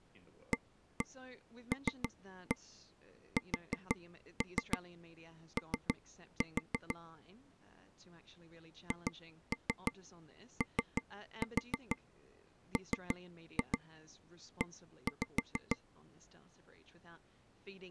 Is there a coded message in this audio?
Yes: tap code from 0.5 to 15.8 s, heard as taps on a table, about 6 knocks a second, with speech in English. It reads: ALSO HOME